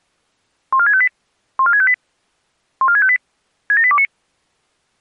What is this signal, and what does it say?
Five-tone selective call (ZVEI), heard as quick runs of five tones, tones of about 70 ms. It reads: 14658 14658 14658 67829